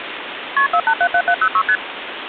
Multi-frequency trunk signalling (R1, as on North American trunks), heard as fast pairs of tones, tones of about 70 ms, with phone line noise. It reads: KP 4877706 ST